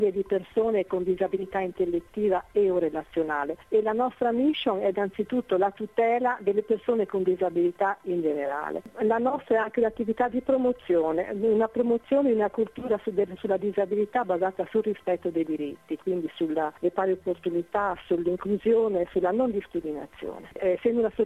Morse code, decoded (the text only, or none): none